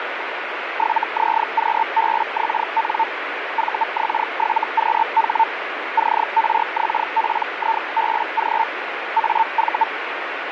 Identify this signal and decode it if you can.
Hellschreiber (Feld-Hell, 122.5 baud), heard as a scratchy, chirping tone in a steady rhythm, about 900 Hz, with radio static. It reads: 7ZQBXN VX7QH CRXPIBG AV